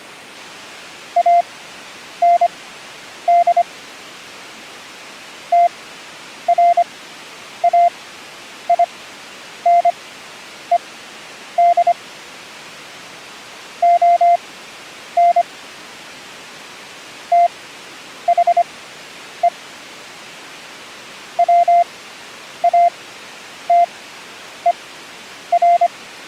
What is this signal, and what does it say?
Morse code, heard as a keyed tone, machine-sent, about 25 wpm, spaced as for 9 wpm, 690 Hz. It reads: AND TRAINED ON THE WATER